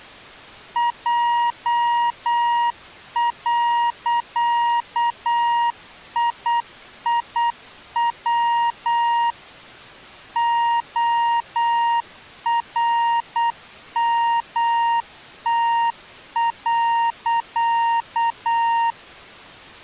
Morse code, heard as a keyed tone, machine-sent, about 8 wpm, 940 Hz. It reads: J.IIW ORMT.